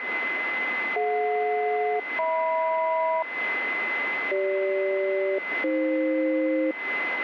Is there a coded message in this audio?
Yes: aircraft SELCAL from 1.0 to 6.7 s, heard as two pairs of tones, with radio static and a steady whistle near 2040 Hz. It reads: DJ-HM CG-AF